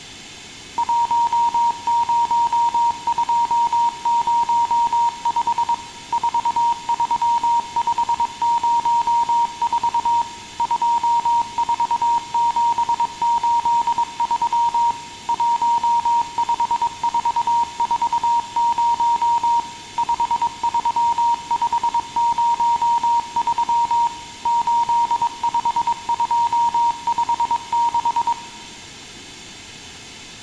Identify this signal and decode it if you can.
Morse code, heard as a keyed tone, machine-sent, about 22 wpm, 940 Hz, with room echo. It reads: 10205 43504 24783 15440 53503 85256